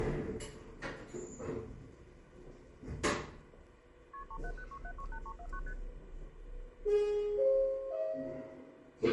Multi-frequency trunk signalling (R1, as on North American trunks), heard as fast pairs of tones, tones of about 70 ms, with phone line noise and the noise inside a lift. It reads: KP 3706768349 ST